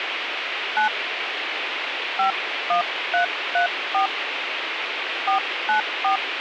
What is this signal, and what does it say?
DTMF, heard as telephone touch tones, dialled by hand, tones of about 110 ms, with phone line noise. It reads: 9 51334 494